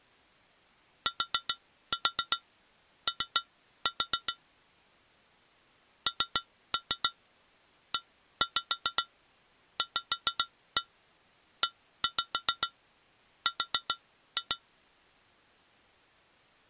Tap code, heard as taps on glass, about 7 knocks a second. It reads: TO NEVER